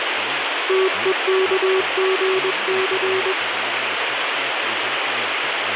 Morse code (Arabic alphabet), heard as a keyed tone, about 21 wpm, 380 Hz, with radio static and speech in English. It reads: تءكغث